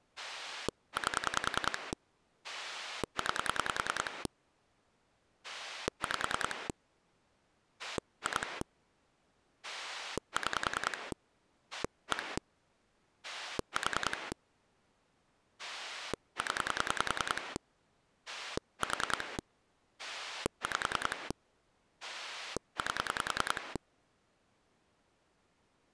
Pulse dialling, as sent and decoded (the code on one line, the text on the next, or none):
8 / 9 / 5 / 2 / 6 / 1 / 4 / 10 / 4 / 5 / 8
8 9 5 2 6 1 4 0 4 5 8